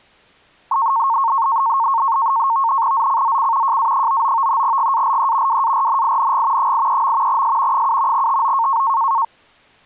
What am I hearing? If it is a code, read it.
NAVTEX (SITOR-B), 100 baud, 170 Hz shift, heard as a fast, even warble, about 1000 Hz centre. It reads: ZCZC JA99 GALE WARNING 83. S 7 TO